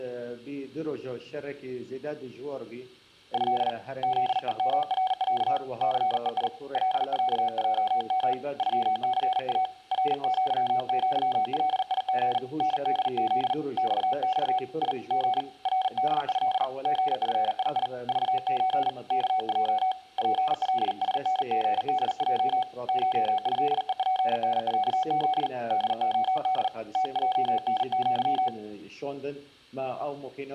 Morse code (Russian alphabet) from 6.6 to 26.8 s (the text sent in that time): ЛЯЙМ ЮЦА РЪЪЛИГ НДЗ ЬЬ И Г РДЭ ГФИИ ЖЧ КЙ ПЛСНГДЙ ШЭЕПНЯЗ ДОД